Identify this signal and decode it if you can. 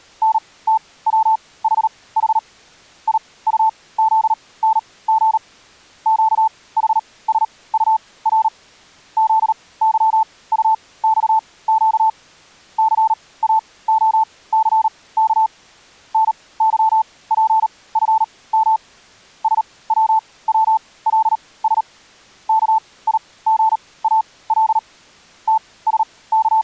Morse code, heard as a keyed tone, machine-sent, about 38 wpm, spaced as for 21 wpm, 880 Hz. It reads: NTWHH IUZNG QHSUR ZYUXQ CAOCK NYPFM SWWLS KIGAL …